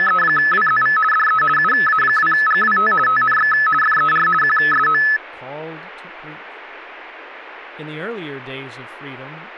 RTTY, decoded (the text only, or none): … DE UA2GWT TNX FER QSO